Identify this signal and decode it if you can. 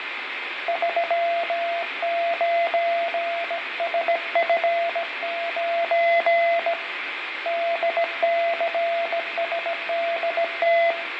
Morse code, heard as a keyed tone, hand-sent with a bug key, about 17 wpm, 680 Hz, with radio static, fading and room echo. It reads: 39SF9 DCSDT